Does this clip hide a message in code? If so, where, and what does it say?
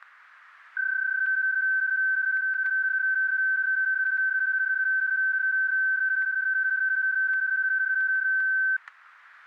Yes: PSK31 (31.25 baud) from 0.8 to 8.8 s, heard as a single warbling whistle, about 1550 Hz, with static crashes.